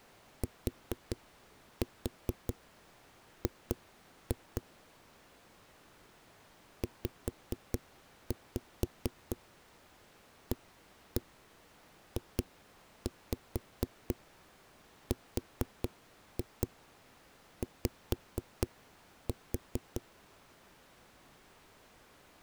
Tap code, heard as knocks on a wall, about 4 knocks a second. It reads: TG ZAJRY